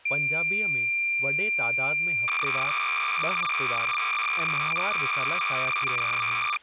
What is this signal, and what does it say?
Cassette data (Kansas City type), 300 baud, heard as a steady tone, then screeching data, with speech in Sindhi.